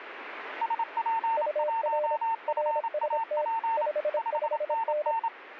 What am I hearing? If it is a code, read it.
Morse code, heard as two keyed tones, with radio static. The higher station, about 27 wpm, 910 Hz: SP1FAP 5NN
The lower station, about 26 wpm, 600 Hz: UR RST 55N